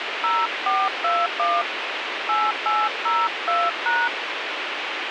DTMF, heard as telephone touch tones, dialled by hand, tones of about 220 ms, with radio hiss. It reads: 0421 8802#